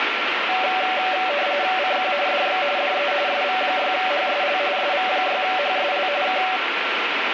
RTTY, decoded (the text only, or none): CQ DX DE SV6HSL SV6HSL K